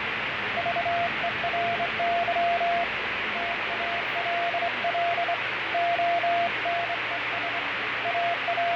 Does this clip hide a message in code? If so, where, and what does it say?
Yes: Morse code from 0.5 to 8.8 s, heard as a keyed tone, hand-sent with a straight key, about 24 wpm, 690 Hz, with heavy radio static, fading and the noise inside a subway train. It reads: VERY TALL ONES …